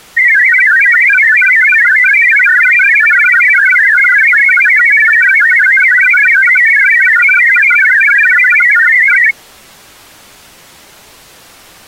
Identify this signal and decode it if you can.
Multi-tone FSK (Olivia or MFSK type), about 1000 Hz wide, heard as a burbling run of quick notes, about 62.5 baud.